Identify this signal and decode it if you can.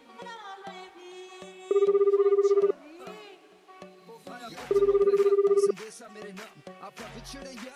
Telephone call progress tone (Japanese plan), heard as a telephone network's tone, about 380, 400, 420 Hz, 1 s on and 2 s off. Ringback tone.